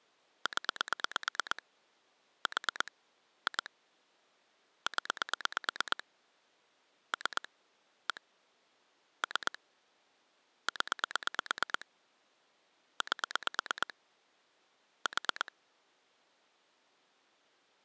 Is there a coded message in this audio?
Yes: pulse dialling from 0.5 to 15.5 s, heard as clicks on a phone line, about 8 pulses a second. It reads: 0 4 2 0 3 1 3 0 8 4